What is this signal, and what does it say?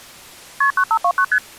Multi-frequency trunk signalling (R1, as on North American trunks), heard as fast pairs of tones, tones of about 70 ms. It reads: KP 9529 ST